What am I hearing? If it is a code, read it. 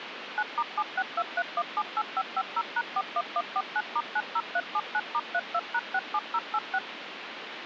DTMF, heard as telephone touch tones, dialled by machine, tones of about 50 ms, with phone line noise. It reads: 9*7623178550#41149*90379*32#67086